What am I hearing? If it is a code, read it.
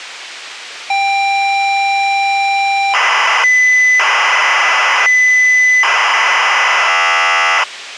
ZX Spectrum tape loading, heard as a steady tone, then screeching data.